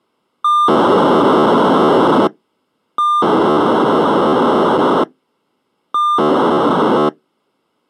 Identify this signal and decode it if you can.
POCSAG pager data (2400 baud), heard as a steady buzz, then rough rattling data.